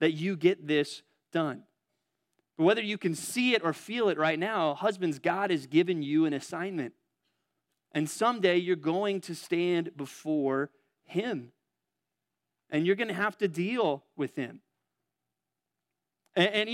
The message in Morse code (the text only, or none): none